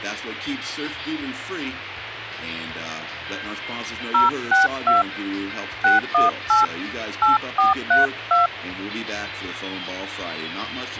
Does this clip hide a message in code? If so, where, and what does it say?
Yes: DTMF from 4.1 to 8.5 s, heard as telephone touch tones, dialled by hand, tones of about 150 ms. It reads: 062 618 8432